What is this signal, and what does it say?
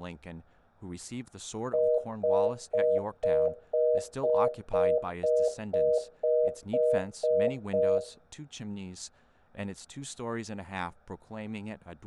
Telephone call progress tone (North American plan), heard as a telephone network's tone, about 480, 620 Hz, 0.25 s on and 0.25 s off, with room echo and speech in English. Congestion tone.